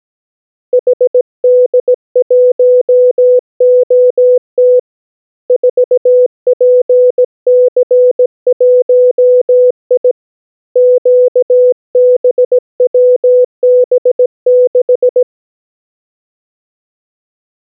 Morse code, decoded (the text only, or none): HD1OT 4PC1I QBWB6